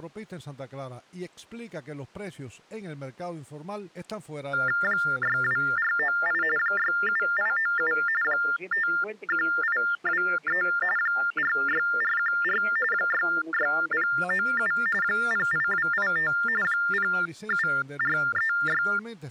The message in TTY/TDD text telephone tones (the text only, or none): 62498 67897 51823 46414 66097 08285 07436